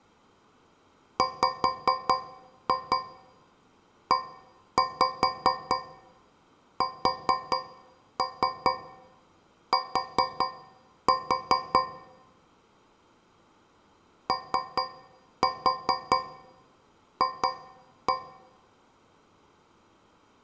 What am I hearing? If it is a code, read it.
Tap code, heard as taps on a metal pipe, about 4 knocks a second, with room echo. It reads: WEST OF